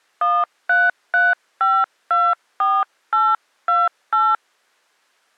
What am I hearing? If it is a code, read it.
DTMF, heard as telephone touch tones, dialled by hand, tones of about 200 ms. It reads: 133524828